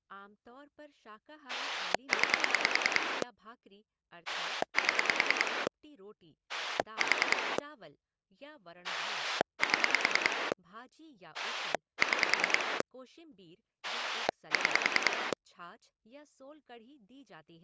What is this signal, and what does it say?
Pulse dialling, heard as a rotary dial, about 10 pulses a second, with speech in Hindi. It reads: 9 7 4 7 6 6